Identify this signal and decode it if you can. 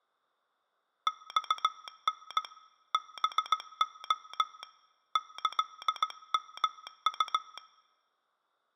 Morse code (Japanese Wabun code), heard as a telegraph sounder, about 17 wpm. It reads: マタ ハレ キヨウ